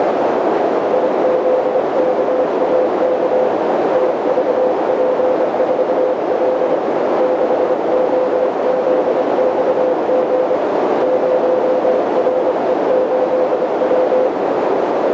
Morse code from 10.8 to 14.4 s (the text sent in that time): 0RE8W